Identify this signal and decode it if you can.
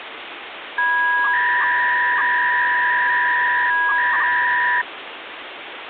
300-baud modem data (V.21 tones), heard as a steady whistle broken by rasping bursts, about 300 baud, 200 Hz shift, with phone line noise.